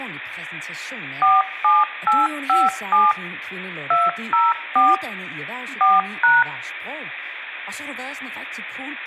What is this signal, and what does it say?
DTMF, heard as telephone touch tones, dialled by machine, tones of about 190 ms, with speech in Danish. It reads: 47857 204 4#